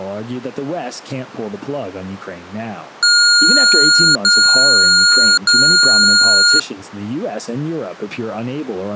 Beep code, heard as beeps from a small speaker, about 1420 Hz, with speech in English. 3 long. In IBM BIOS tables: keyboard card error.